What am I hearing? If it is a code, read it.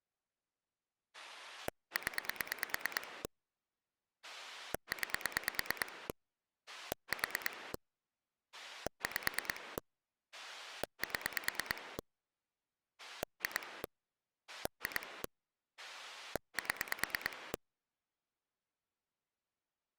Pulse dialling, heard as a rotary dial, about 9 pulses a second. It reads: 0 9 4 5 7 2 2 7